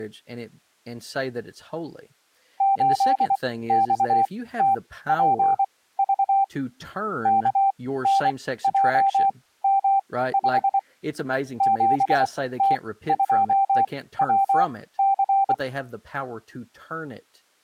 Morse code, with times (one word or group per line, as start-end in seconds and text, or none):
2.6-6.4 8XTPV
7.3-10.8 KNJM5
11.6-15.5 7T2WC